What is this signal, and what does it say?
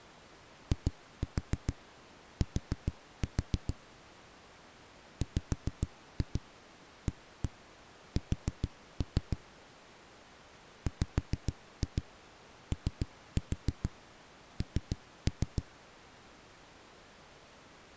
Tap code, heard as knocks on a wall, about 6 knocks a second. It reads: IT WAS WON